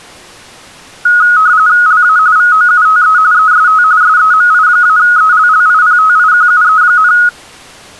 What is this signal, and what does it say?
RTTY (45.45 baud, 170 Hz shift), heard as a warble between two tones, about 1360 Hz centre. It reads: LA VOUTE EST SEMI-ELLIPTIQUE,